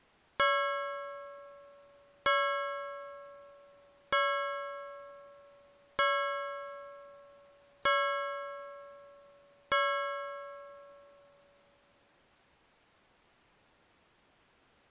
Clock strike, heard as a bell. 6. Six o'clock.